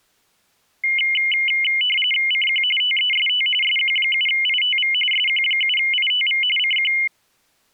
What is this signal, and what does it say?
RTTY (45.45 baud, 850 Hz shift), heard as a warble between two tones, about 2550 Hz centre. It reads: CQ TEST SQ7ITV SQ7ITV CQ